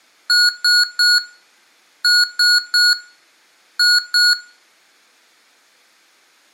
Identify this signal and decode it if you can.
Beep code, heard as beeps from a small speaker, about 1450 Hz, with room echo. 3-3-2.